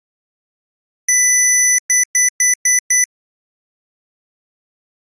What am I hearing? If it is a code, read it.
Beep code, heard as beeps from a small speaker, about 2000 Hz. 1 long, 5 short.